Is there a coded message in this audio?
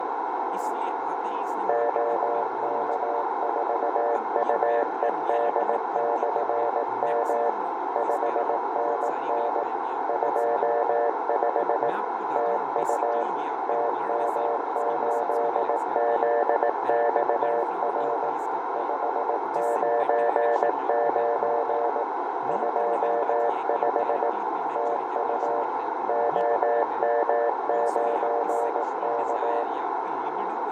Yes: Morse code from 1.6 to 29.7 s, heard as a keyed tone, machine-sent, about 18 wpm, 590 Hz, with radio static, fading, a narrow filter, room echo and speech in Hindi. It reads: OK4UED/M 5NN 25 TU TM8ZXR 599 25 TU OM9K